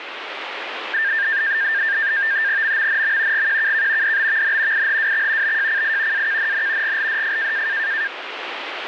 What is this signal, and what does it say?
NAVTEX (SITOR-B), 100 baud, 170 Hz shift, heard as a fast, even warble, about 1700 Hz centre, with radio static. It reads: MMNM GQKK DBVN IHWX BJCI AKNN GLDF